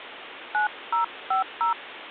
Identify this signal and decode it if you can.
DTMF, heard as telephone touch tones, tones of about 120 ms, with phone line noise. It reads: 9050